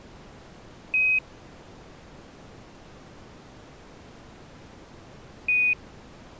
Quindar tones, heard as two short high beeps.